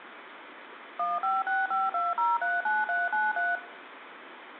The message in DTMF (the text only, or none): 15652039393